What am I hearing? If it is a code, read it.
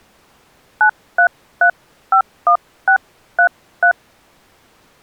DTMF, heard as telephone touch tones, dialled by hand, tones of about 90 ms. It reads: 93351633